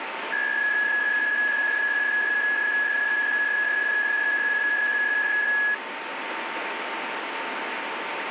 PSK63 (62.5 baud), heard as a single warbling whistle, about 1700 Hz, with radio static and a steady whistle near 910 Hz.